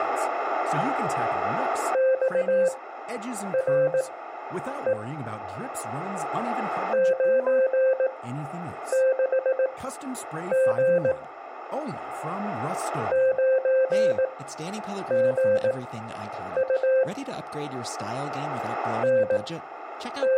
Morse code, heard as a keyed tone, machine-sent, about 18 wpm, spaced as for 8 wpm, 520 Hz, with speech in French. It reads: XRE 96G 9GU …